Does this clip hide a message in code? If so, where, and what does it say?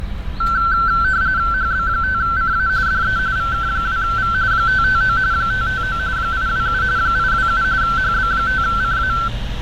Yes: RTTY (45.45 baud, 170 Hz shift) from 0.4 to 9.3 s, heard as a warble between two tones, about 1440 Hz centre, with radio static and street noise. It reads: HB5CA DE VK2V 559 559 827 827 HB5CA